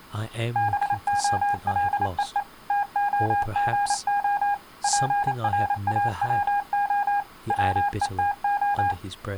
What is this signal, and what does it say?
Morse code (Russian alphabet), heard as a keyed tone, machine-sent, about 28 wpm, 810 Hz, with speech in English. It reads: БОЛЕЕ ТОГО ПРАВО ВЕТО